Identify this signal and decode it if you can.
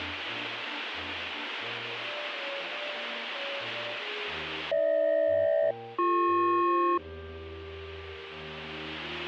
Aircraft SELCAL, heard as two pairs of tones. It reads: GH-BP